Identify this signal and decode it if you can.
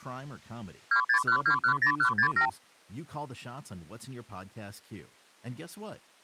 Multi-frequency trunk signalling (R2, with the far end's replies), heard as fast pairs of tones, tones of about 90 ms, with speech in English. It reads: 261210167